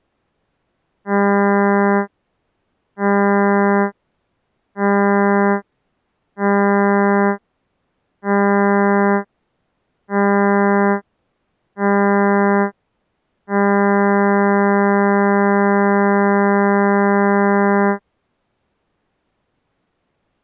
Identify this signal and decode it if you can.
Ship horn signal, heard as a ship's horn, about 200 Hz. 7 short, 1 long. At sea: general emergency alarm.